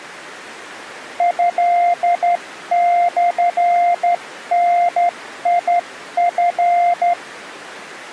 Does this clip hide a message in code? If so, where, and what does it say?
Yes: Morse code (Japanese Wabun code) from 1.1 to 7.2 s, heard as a keyed tone, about 12 wpm, 700 Hz. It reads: トモダチ